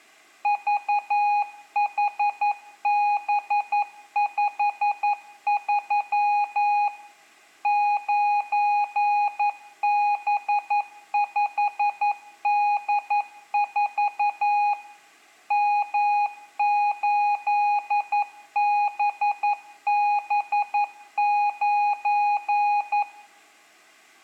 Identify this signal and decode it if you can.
Morse code, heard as a keyed tone, machine-sent, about 11 wpm, 830 Hz, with room echo. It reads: VHB53 9B5D4 M8BB9